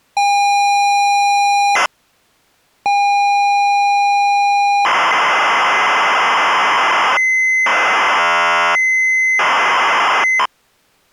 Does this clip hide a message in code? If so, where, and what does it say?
Yes: ZX Spectrum tape loading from 0.2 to 10.5 s, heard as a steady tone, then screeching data.